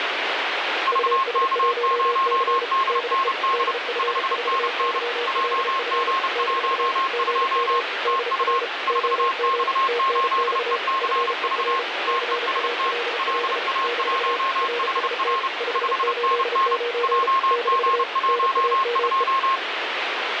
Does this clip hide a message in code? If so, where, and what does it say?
Yes: Morse code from 0.8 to 19.6 s, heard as two keyed tones, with heavy radio static. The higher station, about 30 wpm, 1070 Hz: VK0DND 5NN JG12 TU 4X8ECV TEST LA1HR 5NN JG12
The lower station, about 34 wpm, 480 Hz: US1C DE DF4YLF - GM DR OM TNX FER CALL - RST 589 - NAME